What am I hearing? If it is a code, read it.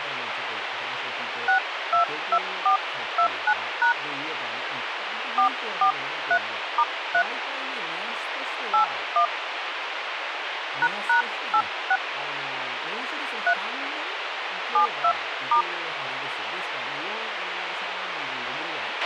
DTMF, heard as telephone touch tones, dialled by hand, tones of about 90 ms, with radio hiss, a squelch burst at the end and speech in Japanese. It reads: 622429# 443*3 81 ##86 3 72*